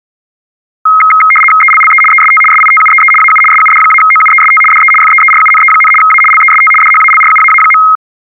RTTY (75 baud, 850 Hz shift), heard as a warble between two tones, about 1700 Hz centre. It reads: ELLE EST SITUEE AU SUD-OUEST DE FEERUNE, A LEST DHALRUAA.